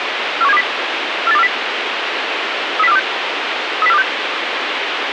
Five-tone selective call (EEA), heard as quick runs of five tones, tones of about 40 ms, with radio hiss. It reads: 41720 48240 30426 30426